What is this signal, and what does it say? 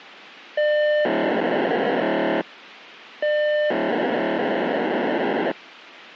POCSAG pager data (1200 baud), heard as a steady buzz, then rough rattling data, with radio hiss.